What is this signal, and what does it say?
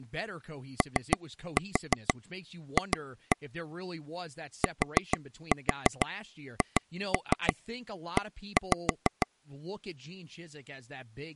Tap code, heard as taps on a table, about 6 knocks a second, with speech in English. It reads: OF THE